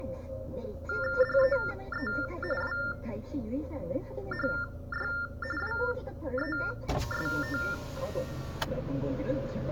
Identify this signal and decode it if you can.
TTY/TDD text telephone tones (45.45 baud Baudot), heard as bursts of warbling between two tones, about 400 Hz shift, 1600 Hz centre, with the noise inside a car. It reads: DEE WHY WEST